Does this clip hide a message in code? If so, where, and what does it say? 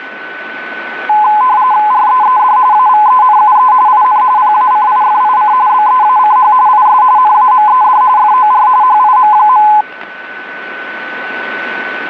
Yes: RTTY (45.45 baud, 170 Hz shift) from 1.1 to 9.8 s, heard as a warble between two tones, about 930 Hz centre, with radio static and a steady whistle near 1500 Hz. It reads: REED AVENUE IN PACIFIC BEACH IS NAMED FOR HIM.